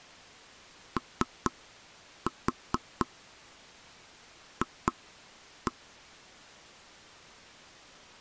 Tap code, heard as knocks on wood, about 4 knocks a second. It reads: OF